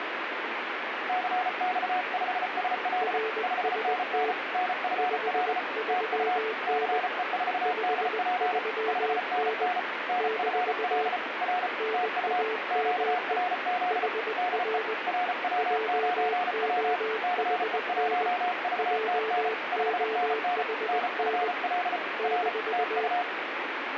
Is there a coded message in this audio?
Yes: Morse code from 1.0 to 23.3 s, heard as two keyed tones, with radio static. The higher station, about 34 wpm, 720 Hz: CX5SL 5NN NFL TU CE4DP 5NN NFL R TU QRZ DE RW9W CE1VTN 5NN NFL R TU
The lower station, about 20 wpm, 440 Hz: RST 53N 53N - NAME HR JOHN JOHN -